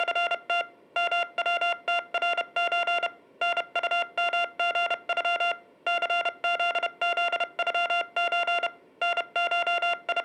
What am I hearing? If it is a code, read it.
Morse code (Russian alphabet), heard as electronic beeps, machine-sent, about 31 wpm, spaced as for 28 wpm, 690 Hz, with room echo. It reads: … МВТРЧ НУМГЮ ЦЗЗЮЧ …